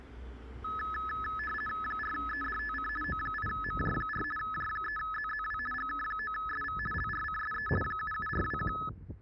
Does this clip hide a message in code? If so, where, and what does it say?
Yes: RTTY (50 baud, 450 Hz shift) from 0.6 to 8.9 s, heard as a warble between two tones, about 1500 Hz centre, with street noise. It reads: 4EDTC O8MJ4 J3ZZW GK9SV LRCSE 77421